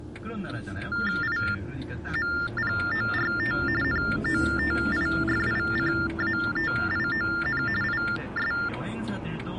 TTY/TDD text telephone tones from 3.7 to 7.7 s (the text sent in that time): NOTIFICATION